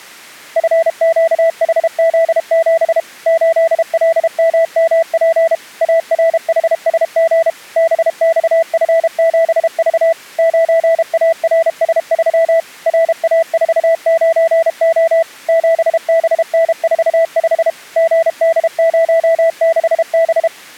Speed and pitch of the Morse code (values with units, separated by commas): 32 wpm, 660 Hz